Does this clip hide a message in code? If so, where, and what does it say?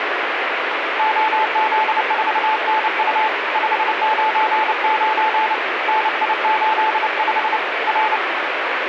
Yes: Morse code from 0.9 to 8.2 s, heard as a keyed tone, hand-sent with a paddle, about 29 wpm, 870 Hz, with radio static. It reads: OZ4NU 599 NI85 R